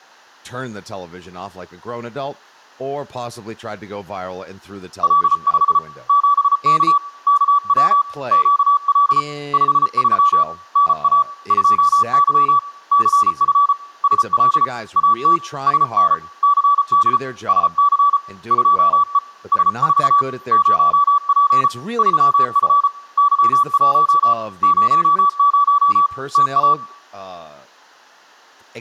Morse code, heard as a keyed tone, hand-sent with a paddle, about 34 wpm, 1150 Hz, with speech in English. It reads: L5 7K KW QL 53 NA 2Y CF SL AT SN CD SC 2E S4 0P 3F Y1 00 TA